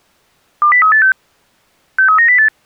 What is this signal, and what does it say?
Five-tone selective call (CCIR), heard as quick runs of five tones, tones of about 100 ms. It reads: 20386 63908